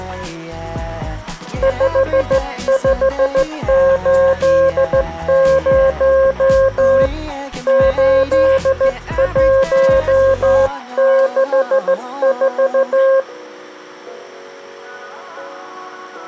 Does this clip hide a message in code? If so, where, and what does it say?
Yes: Morse code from 1.6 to 13.3 s, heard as a keyed tone, hand-sent with a straight key, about 14 wpm, 540 Hz. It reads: 5580 8164